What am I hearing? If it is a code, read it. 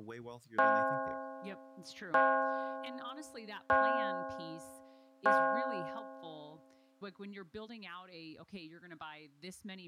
Clock strike, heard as a bell, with speech in English. 4. Four o'clock.